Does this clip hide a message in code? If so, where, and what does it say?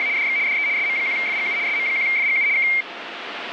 Yes: RTTY (75 baud, 170 Hz shift) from 0.0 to 2.8 s, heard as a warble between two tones, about 2200 Hz centre, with radio static. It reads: … DX DE SM1FGU SM1FGU K